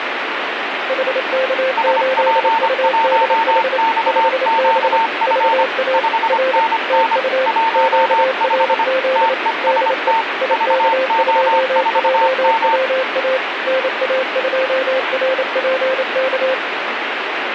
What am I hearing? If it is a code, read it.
Morse code, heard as two keyed tones, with radio static. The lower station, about 28 wpm, 520 Hz: HK8UDH 5B VA R TU QRZ DE IK2JWA NA2RPK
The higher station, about 25 wpm, 900 Hz: SP1XQF 5NN 15 TEST VO4M